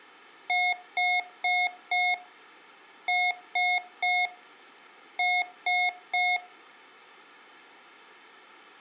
Beep code, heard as beeps from a small speaker, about 720 Hz, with room echo. 4-3-3. In Phoenix BIOS tables: timer channel 2 failure.